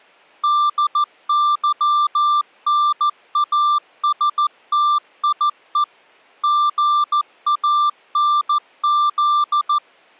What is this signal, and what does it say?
Morse code, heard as a keyed tone, machine-sent, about 14 wpm, 1180 Hz. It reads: DYNASTIE GANZ